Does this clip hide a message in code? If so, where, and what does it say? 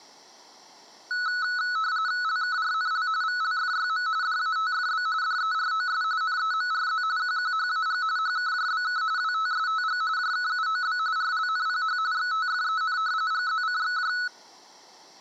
Yes: RTTY (45.45 baud, 170 Hz shift) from 1.1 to 14.3 s, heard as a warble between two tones, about 1390 Hz centre. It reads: LKRNL VLFYM DATFB DEROS NEMRZ QQHAG HKJBK WTSTG JKUOB RLNPH XTFEN GZCXJ